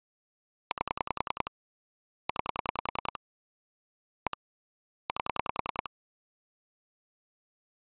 Pulse dialling, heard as clicks on a phone line, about 10 pulses a second. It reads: 8 9 1 8